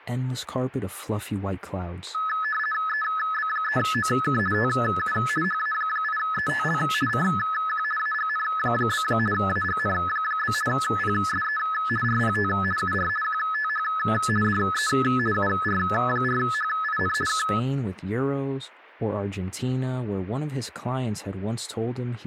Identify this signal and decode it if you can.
RTTY (50 baud, 450 Hz shift), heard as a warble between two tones, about 1500 Hz centre, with static crashes and speech in English. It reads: EB3OK TU HA8ETL CQ AGN? AGN? PSE RPT UR QTH DE UR4HIN K